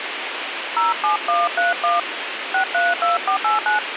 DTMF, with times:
0.8-2.0 07131
2.5-3.8 632489

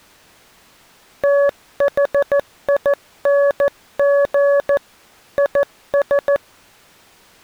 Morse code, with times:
1.2-4.8 THING
5.4-6.4 IS

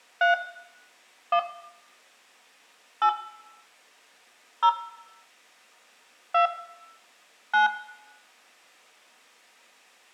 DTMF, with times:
0.2-0.3 3
1.3-1.4 1
3.0-3.1 8
4.6-4.7 0
6.3-6.5 2
7.5-7.7 9

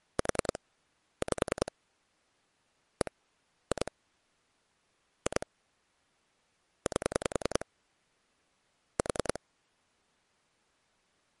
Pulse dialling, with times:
0.2-0.6 4
1.2-1.7 5
3.0-3.1 1
3.7-3.9 2
5.3-5.5 2
6.9-7.7 8
9.0-9.4 4

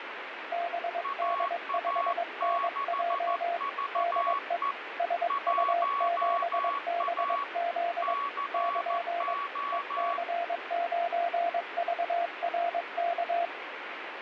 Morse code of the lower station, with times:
0.5-3.6 BD5NJ
4.0-4.6 DE
5.0-8.1 SU7BZ
8.5-9.3 <KN>
9.7-13.4 EC9VRK

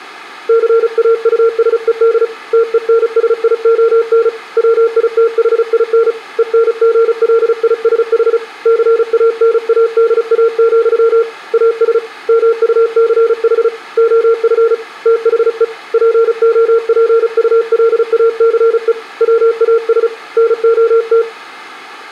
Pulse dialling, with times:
none

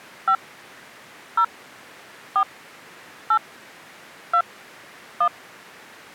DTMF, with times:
0.3-0.4 5
1.4-1.4 0
2.4-2.4 4
3.3-3.4 8
4.3-4.4 2
5.2-5.3 1

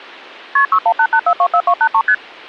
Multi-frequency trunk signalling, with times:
0.6-0.7 KP
0.7-2.0 6188424283
2.1-2.1 ST

